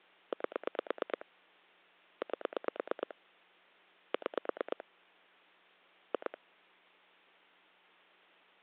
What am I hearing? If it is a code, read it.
Pulse dialling, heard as clicks on a phone line, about 9 pulses a second. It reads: 8 8 6 2